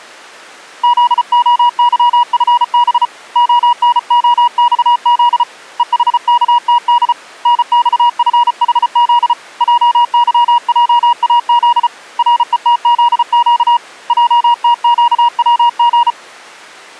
Morse code, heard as a keyed tone, hand-sent with a paddle, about 34 wpm, 960 Hz. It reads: ZOYFB ONOXZ EHKTD NXFHZ JYJAZ RETZQ JTQWG